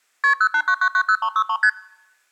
Multi-frequency trunk signalling (R1, as on North American trunks), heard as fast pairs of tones, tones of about 70 ms. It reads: KP 089990363 ST